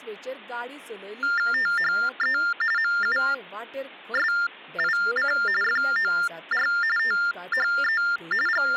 TTY/TDD text telephone tones (45.45 baud Baudot), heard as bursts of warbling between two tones, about 400 Hz shift, 1600 Hz centre, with speech in Goan Konkani. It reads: THE MUSIC FOR THE …